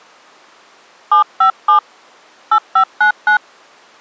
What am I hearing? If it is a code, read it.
DTMF, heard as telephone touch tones, dialled by hand, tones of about 100 ms. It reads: 757 8599